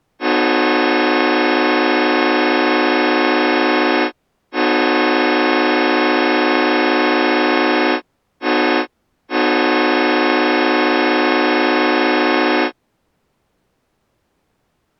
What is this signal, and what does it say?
Train horn signal, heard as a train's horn. 2 long, 1 short, 1 long. On North American railways: approaching a public crossing.